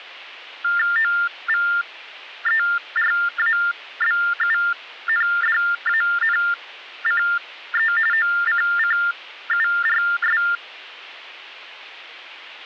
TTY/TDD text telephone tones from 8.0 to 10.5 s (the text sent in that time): OCCURS